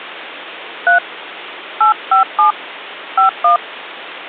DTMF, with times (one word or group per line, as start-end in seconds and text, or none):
0.9-1.0 3
1.8-2.5 857
3.2-3.6 51